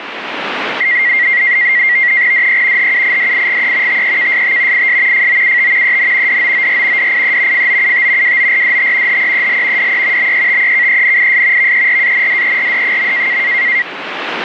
NAVTEX (SITOR-B), 100 baud, 170 Hz shift, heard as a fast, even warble, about 2000 Hz centre, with radio static. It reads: DE HUIDIGE TEKST IS FOUT EN DOOR DIE FOUT WORDT HEEL DE BETEKENIS VERANDERD.